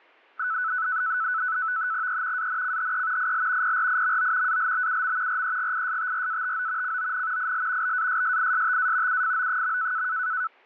NAVTEX (SITOR-B), 100 baud, 170 Hz shift, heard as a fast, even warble, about 1400 Hz centre. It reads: E ANCHE IL PRIMO ALBUM REGISTRATO CON IL BASSISTA UFO.